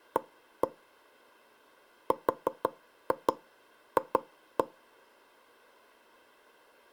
Tap code, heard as knocks on wood, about 5 knocks a second. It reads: A RF